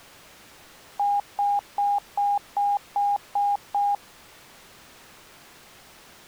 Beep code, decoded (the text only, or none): 8 short